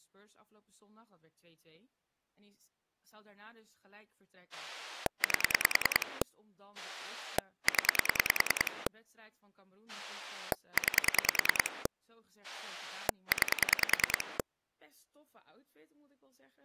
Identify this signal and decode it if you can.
Pulse dialling, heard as a rotary dial, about 10 pulses a second, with speech in Dutch. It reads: 8 0 9 9